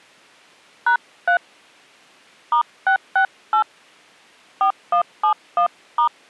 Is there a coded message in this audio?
Yes: DTMF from 0.9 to 6.1 s, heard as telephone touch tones, dialled by hand, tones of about 100 ms. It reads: #3 *668 4171*